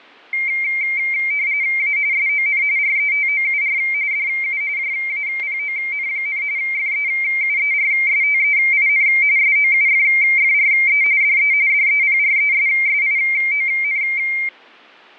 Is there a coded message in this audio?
Yes: RTTY (45.45 baud, 170 Hz shift) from 0.3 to 14.5 s, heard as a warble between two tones, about 2200 Hz centre, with fading and static crashes. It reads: A SON RETOUR DU JAPON, FEUERSTEIN SOUFFRE DE DEPRESSION